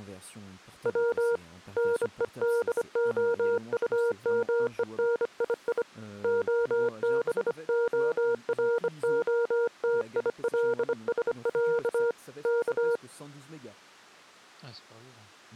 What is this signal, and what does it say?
Morse code (Russian alphabet), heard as a keyed tone, hand-sent with a bug key, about 25 wpm, 470 Hz, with speech in French. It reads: В НЕДОУМЕНИИ ОБОРОТИЛСЯ К